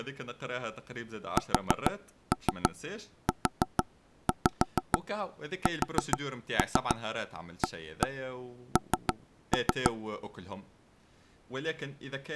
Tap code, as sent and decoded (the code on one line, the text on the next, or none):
4-3 4-5 4-3 1-1 3-3
SUSAN